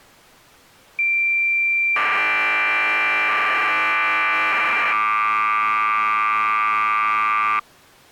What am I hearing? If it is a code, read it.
Cassette data (Kansas City type), 1200 baud, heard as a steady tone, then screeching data.